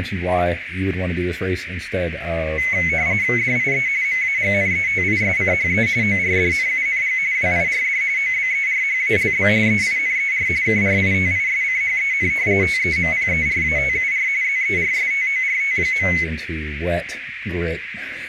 RTTY (45.45 baud, 170 Hz shift), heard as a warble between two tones, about 2150 Hz centre, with radio static, a narrow filter and speech in English. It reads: DIE MAGNETISCHE ORDNUNG WIRD OBERHALB EINER KRITISCHEN TEMPERATUR ZERSTORT.